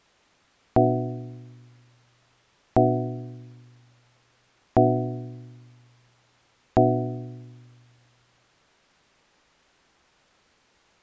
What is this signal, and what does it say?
Clock strike, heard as a bell. 4. Four o'clock.